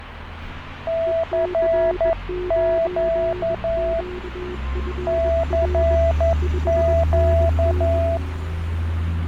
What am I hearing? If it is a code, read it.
Morse code, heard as two keyed tones, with radio static and street noise. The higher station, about 11 wpm, 660 Hz: CQ CQ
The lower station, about 21 wpm, 360 Hz: EC9QFR 5NN